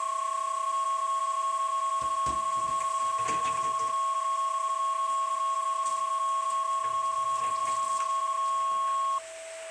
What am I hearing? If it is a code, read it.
PSK31 (31.25 baud), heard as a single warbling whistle, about 1090 Hz, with a steady whistle near 650 Hz and kitchen noise.